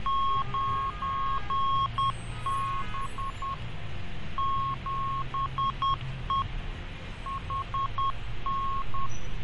Morse code, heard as a keyed tone, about 10 wpm, 1090 Hz, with radio static, fading and street noise. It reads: 9B 7E HN